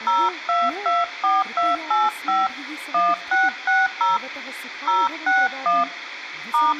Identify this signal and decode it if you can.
DTMF, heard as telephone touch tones, dialled by hand, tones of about 190 ms, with room echo and speech in Sanskrit. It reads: 0224285 1660 061 *